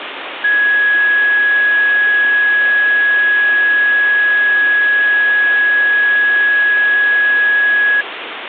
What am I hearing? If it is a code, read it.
A steady tone, with phone line noise. There is no code.